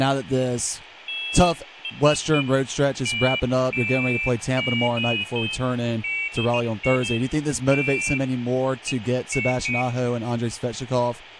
Pairs of high tones at irregular times, with radio hiss, room echo and speech in English. There is no code.